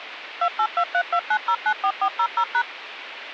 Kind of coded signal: DTMF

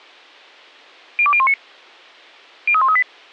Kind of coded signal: five-tone selective call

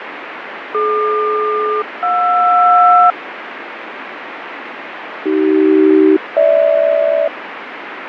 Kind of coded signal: aircraft SELCAL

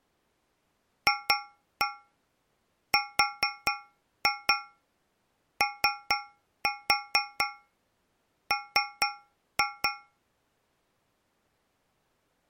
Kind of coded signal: tap code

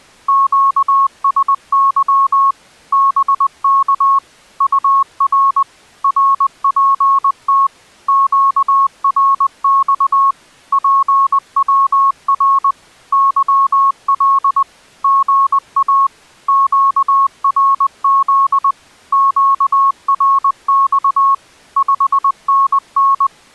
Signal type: Morse code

